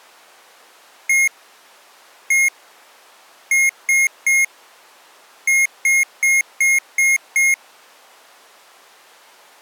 Beep code, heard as beeps from a small speaker, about 2150 Hz. 1-1-3-6.